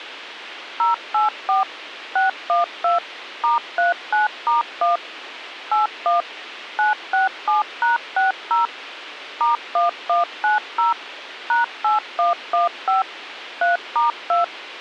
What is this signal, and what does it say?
DTMF, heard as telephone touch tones, dialled by machine, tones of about 140 ms, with radio hiss. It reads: 084 612 *39*1 81 967#60 *1190 #8115 3*2